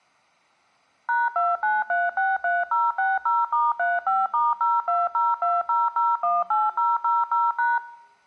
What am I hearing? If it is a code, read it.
DTMF, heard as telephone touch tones, dialled by machine, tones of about 190 ms. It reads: #29363060*35*02020018000#